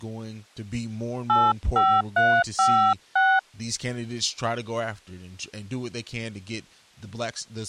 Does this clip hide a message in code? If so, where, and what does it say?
Yes: DTMF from 1.3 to 3.4 s, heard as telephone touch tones, dialled by hand, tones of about 260 ms, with speech in English. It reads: 85356